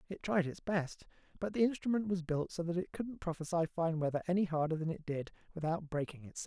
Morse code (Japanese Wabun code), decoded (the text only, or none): none